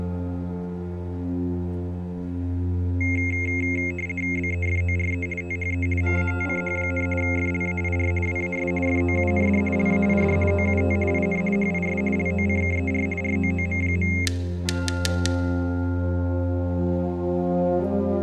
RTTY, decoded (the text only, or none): BEFORE THE MATCH, FLAIR WAS FOUND LAID OUT IN HIS LOCKER ROOM.